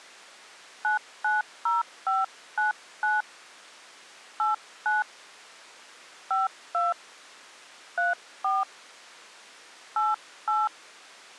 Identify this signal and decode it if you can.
DTMF, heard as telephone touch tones, dialled by hand, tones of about 160 ms. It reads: 990599 89 52 34 88